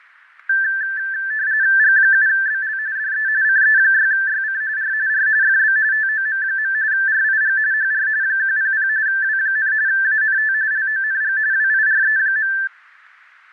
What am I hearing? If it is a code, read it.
RTTY (45.45 baud, 170 Hz shift), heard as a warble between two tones, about 1650 Hz centre, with fading. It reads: G7BL DE CE6YC R R FB TOM. RIG HR 100 W, ANT LONG WIRE.